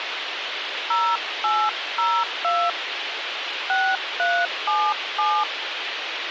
DTMF, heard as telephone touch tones, dialled by hand, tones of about 250 ms, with radio hiss and a squelch burst at the end. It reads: 0802 6377